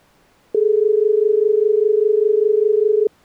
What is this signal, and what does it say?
Telephone call progress tone (as in Australia), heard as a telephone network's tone, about 430 Hz. Dial tone.